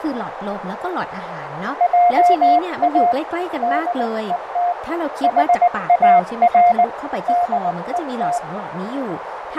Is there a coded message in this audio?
Yes: Morse code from 1.7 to 8.4 s, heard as a keyed tone, hand-sent with a paddle, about 19 wpm, 710 Hz, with radio static, fading, a narrow filter and speech in Thai. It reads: JA DET HAR DET